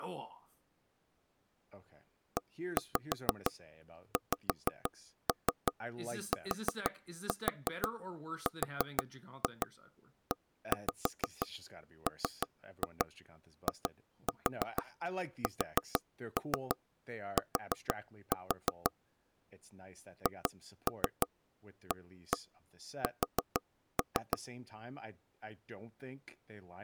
Tap code, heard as knocks on wood, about 6 knocks a second, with speech in English. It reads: EXTREMIST HAS